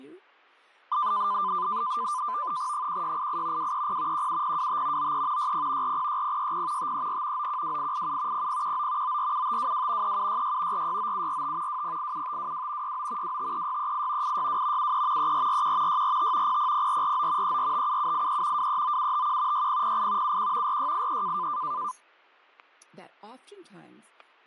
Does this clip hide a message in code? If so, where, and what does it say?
Yes: NAVTEX (SITOR-B), 100 baud, 170 Hz shift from 0.9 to 21.9 s, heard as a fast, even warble, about 1100 Hz centre, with fading, static crashes and speech in English. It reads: 1688 230 17025 93 60 406060 534 912887 0019 947522 3766 469745 2087522 69 253638 862 73 3441 645 000449 3457783 239751 6008 71 4683